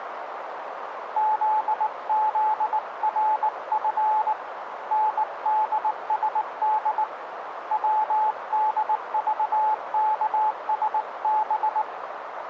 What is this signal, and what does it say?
Morse code, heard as a keyed tone, hand-sent with a bug key, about 19 wpm, 860 Hz, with radio static and a narrow filter. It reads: ZZRF NDSD WDVKSB